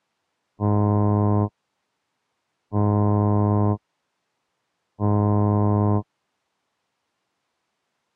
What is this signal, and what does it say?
Ship horn signal, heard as a ship's horn, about 100 Hz. 3 short. At sea: I am operating astern propulsion.